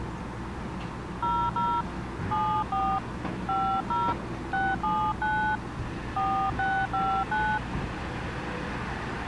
DTMF, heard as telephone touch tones, dialled by hand, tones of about 280 ms, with the noise of a residential street. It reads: 00 74 50 679 4659